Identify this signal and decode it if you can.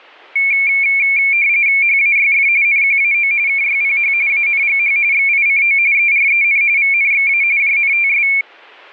RTTY (45.45 baud, 170 Hz shift), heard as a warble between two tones, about 2300 Hz centre. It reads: HAYF NQAO KYPH ANGH XICO EREN VNXA JNTS